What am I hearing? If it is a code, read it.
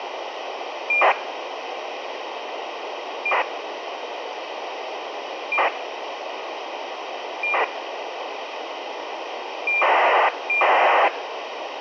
ACARS aircraft data, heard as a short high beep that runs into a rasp, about 2400 baud, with radio hiss.